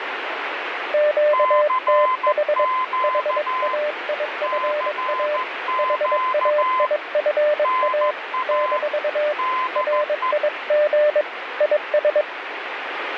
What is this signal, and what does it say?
Morse code, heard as two keyed tones, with radio static. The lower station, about 22 wpm, 600 Hz: QTH HAIFA HAIFA - RIG IS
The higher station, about 14 wpm, 1030 Hz: CQ CQ NA DE